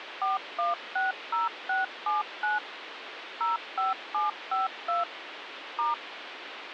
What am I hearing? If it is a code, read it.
DTMF, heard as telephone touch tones, dialled by machine, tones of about 160 ms, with phone line noise. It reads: 4160679 05752 *